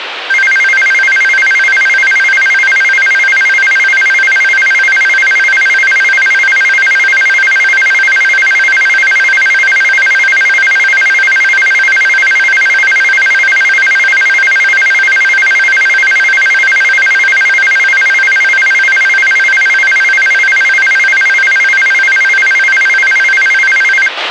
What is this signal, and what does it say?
A tone that alternates evenly between two pitches, with radio hiss and a squelch burst at the end. There is no code.